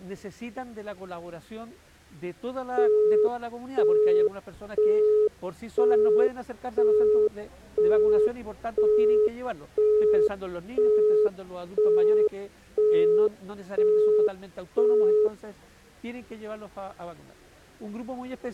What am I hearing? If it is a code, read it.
Telephone call progress tone (single-tone plan, as in Europe, Japan and elsewhere), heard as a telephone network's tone, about 420 Hz, 0.5 s on and 0.5 s off. Busy tone.